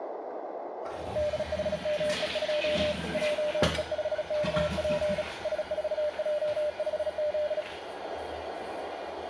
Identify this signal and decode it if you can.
Morse code, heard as a keyed tone, hand-sent with a bug key, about 36 wpm, 600 Hz, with radio static, a narrow filter and the noise of a restroom. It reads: DHME2 JE5KP S4J5Z